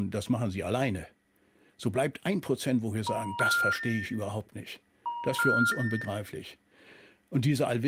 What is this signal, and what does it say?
Telephone call progress tone (ITU plan), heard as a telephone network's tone, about 950, 1400, 1800 Hz, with room echo and speech in German. Special information tone.